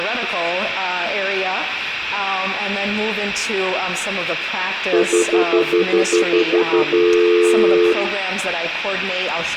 Telephone call progress tone (North American plan), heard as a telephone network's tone, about 350, 440 Hz, 0.1 s on and 0.1 s off, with room echo. Stutter dial tone.